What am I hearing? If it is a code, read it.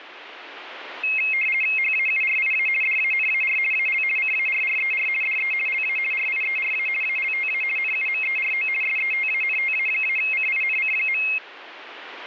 RTTY (50 baud, 450 Hz shift), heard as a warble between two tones, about 2350 Hz centre, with radio static. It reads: HAURIA DANAR AL CARRER DE LA RIERA ALTA NUMERO SETANTA-CINC.